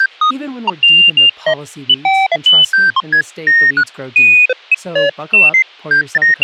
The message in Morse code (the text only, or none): none